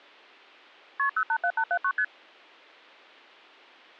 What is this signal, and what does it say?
Multi-frequency trunk signalling (R1, as on North American trunks), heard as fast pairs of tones, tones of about 70 ms. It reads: KP 087879 ST